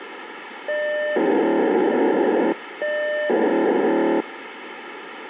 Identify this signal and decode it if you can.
POCSAG pager data (1200 baud), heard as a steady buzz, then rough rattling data, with radio hiss.